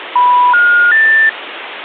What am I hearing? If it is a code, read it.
Telephone call progress tone (North American plan), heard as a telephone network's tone, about 980, 1430, 1800 Hz, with phone line noise. Special information tone.